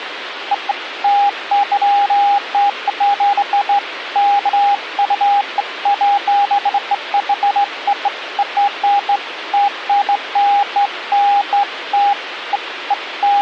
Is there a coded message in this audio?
No, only beeps of irregular length, with phone line noise.